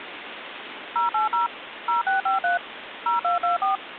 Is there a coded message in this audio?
Yes: DTMF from 1.0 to 3.8 s, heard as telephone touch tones, dialled by machine, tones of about 140 ms, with phone line noise. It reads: 080 0653 0224